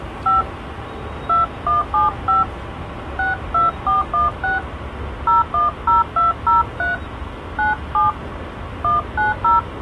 DTMF, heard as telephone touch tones, dialled by hand, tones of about 150 ms, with hum and the noise of a subway station. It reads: 5 2175 62416 010203 97 190